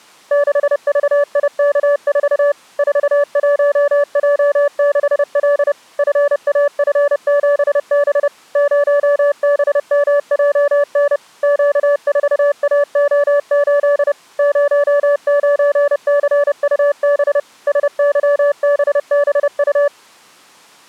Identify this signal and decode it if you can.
Morse code, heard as a keyed tone, machine-sent, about 30 wpm, 580 Hz. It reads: 6VIK4 41J6L FAF7B 0BMJN Q4AO8 09CUB SYBBU